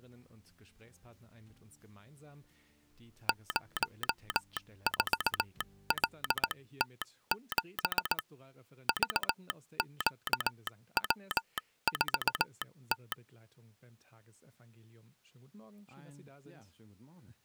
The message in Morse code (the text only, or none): 04LT7 VQW4T